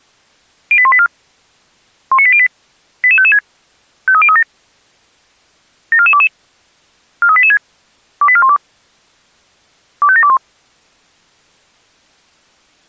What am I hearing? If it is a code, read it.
Five-tone selective call (ZVEI), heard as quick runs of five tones, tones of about 70 ms. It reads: 08184 19808 88556 53037 74422 43886 28412 25721